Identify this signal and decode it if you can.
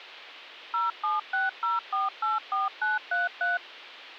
DTMF, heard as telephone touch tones, dialled by machine, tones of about 160 ms. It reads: 0760484933